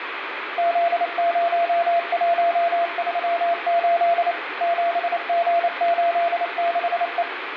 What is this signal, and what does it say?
Morse code, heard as a keyed tone, machine-sent, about 28 wpm, 680 Hz, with radio static and room echo. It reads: Z0138 7G86E